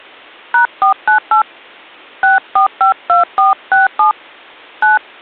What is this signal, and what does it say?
DTMF, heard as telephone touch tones, dialled by hand, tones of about 120 ms. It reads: #498 6452467 9